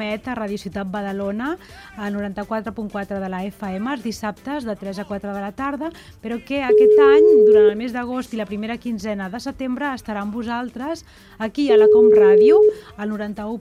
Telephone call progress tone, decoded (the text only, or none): ringback tone